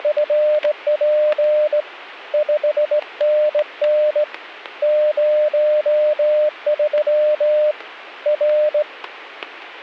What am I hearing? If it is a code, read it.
Morse code, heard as a keyed tone, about 18 wpm, 600 Hz, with static crashes. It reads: … 5NN 03 R